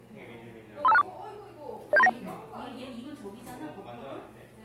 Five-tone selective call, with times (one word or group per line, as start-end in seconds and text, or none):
0.8-1.0 35264
1.9-2.1 07391